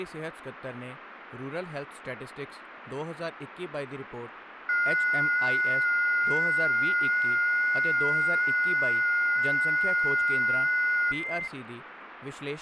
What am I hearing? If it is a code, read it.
FT8 (several signals at once), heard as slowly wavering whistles, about 6.25 baud, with radio static and speech in Punjabi.